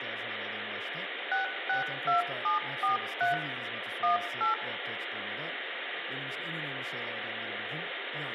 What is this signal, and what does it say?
DTMF, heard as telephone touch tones, dialled by machine, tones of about 130 ms, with phone line noise, room echo and speech in Turkish. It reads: 662743 18